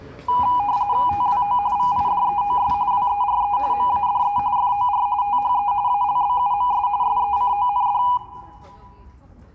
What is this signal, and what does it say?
RTTY (45.45 baud, 170 Hz shift), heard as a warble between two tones, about 900 Hz centre, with room echo and the noise of a residential street. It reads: TWO VIDEOS WERE MADE FOR THE ALBUMS SECOND